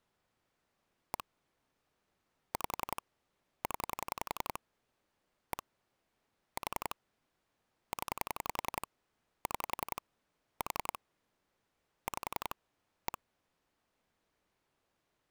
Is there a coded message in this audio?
Yes: pulse dialling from 1.1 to 13.2 s, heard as clicks on a phone line, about 11 pulses a second. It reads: 1 5 0 1 4 0 6 4 5 1